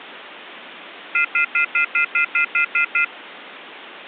Telephone call progress tone (North American plan), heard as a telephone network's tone, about 1400, 2050, 2450, 2600 Hz, 0.1 s on and 0.1 s off, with phone line noise. Off-hook warning tone.